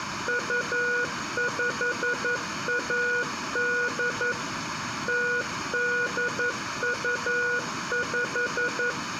Morse code (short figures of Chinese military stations), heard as a keyed tone, machine-sent, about 11 wpm, 480 Hz, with room echo. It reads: 2518 0825